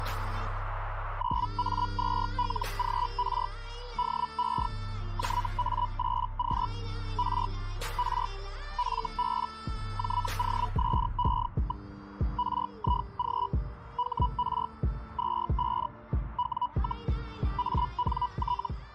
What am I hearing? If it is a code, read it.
Hellschreiber (Feld-Hell, 122.5 baud), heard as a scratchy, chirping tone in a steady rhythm, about 980 Hz. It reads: 9A2LGR DE JA8Q R R FB JOSE. RIG HR 25 W, ANT